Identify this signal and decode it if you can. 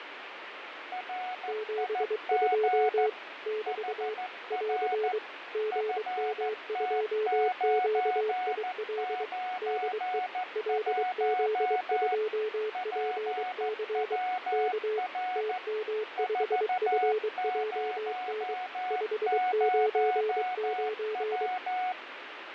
Morse code, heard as two keyed tones, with radio static and fading. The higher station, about 14 wpm, 740 Hz: RIG HR FT991 PWR 400W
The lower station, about 23 wpm, 430 Hz: 72 <BT> <AR> GM2QIL DE LZ2PC K TM5FJN 599